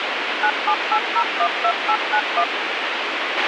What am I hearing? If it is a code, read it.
DTMF, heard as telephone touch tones, dialled by machine, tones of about 70 ms, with radio hiss and a squelch burst at the end. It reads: 978012891